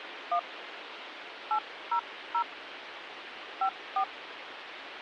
DTMF, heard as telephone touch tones, dialled by hand, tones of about 80 ms, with phone line noise. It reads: 1 800 54